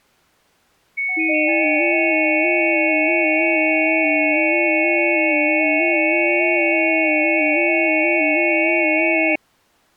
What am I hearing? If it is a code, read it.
FT8 (several signals at once), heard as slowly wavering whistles, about 6.25 baud.